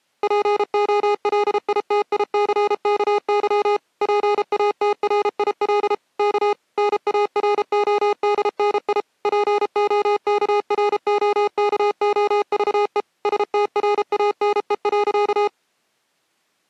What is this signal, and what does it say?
Morse code, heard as electronic beeps, machine-sent, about 33 wpm, 410 Hz. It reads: POLITICKY PATRIL K NARODNI POKROKOVE STRANE.